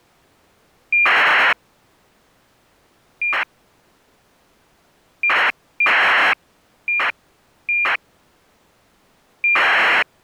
ACARS aircraft data, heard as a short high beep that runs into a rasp, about 2400 baud.